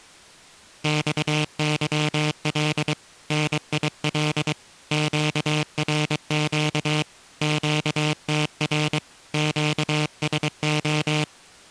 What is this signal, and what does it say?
Morse code, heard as a buzzer, hand-sent with a paddle, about 23 wpm. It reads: XYL NIL QRQ QTR QSO